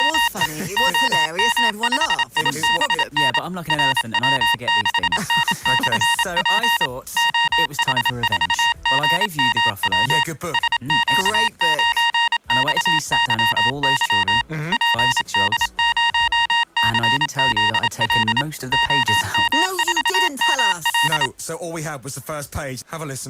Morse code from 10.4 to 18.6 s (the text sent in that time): SQ9XYY PD0CZL